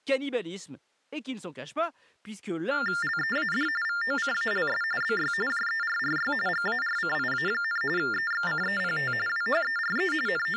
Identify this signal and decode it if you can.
TTY/TDD text telephone tones (45.45 baud Baudot), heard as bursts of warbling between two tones, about 400 Hz shift, 1600 Hz centre, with speech in French. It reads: LEAD VOCALS BY JERRY GARCIA, EXCEPT WHERE …